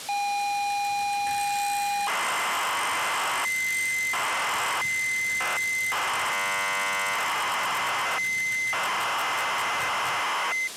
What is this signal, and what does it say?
ZX Spectrum tape loading, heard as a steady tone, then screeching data, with tape hiss.